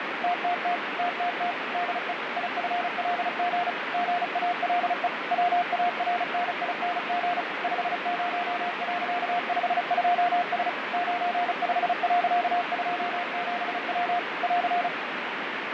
Morse code, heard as a keyed tone, machine-sent, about 35 wpm, 710 Hz, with heavy radio static and fading. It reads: TTT TTT DE IFLG GALE WARNING 50.52S 95.27W <AR>